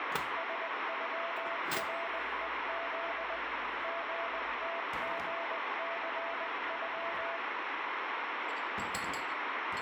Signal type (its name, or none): Morse code